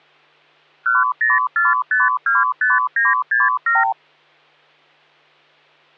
Multi-frequency trunk signalling (R2, with the far end's replies), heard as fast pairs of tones, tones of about 180 ms, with hum. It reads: 104525967